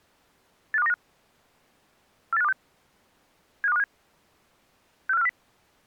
Five-tone selective call (EEA), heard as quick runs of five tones, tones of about 40 ms. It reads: 85295 48526 75257 64540